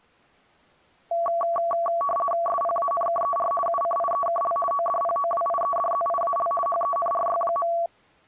RTTY (50 baud, 450 Hz shift), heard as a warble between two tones, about 900 Hz centre. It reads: SPANKER UCIEKL ODPOWIEDZIAL HENRY.